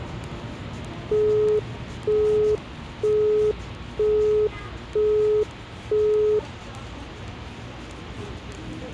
Telephone call progress tone (single-tone plan, as in Europe, Japan and elsewhere), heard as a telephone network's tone, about 420 Hz, 0.48 s on and 0.48 s off, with the noise of a residential street. Busy tone.